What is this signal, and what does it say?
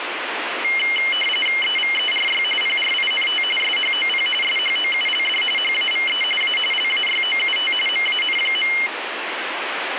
RTTY (45.45 baud, 850 Hz shift), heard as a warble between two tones, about 2550 Hz centre, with radio static. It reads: EVERY PRINT SHOP SHOULD HAVE A LAYOUT MAN.